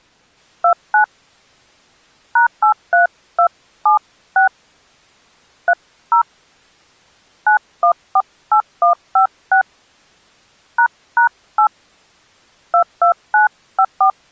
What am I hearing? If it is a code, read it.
DTMF, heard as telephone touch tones, dialled by hand, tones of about 90 ms. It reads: 29 #83276 30 9148156 ##8 22954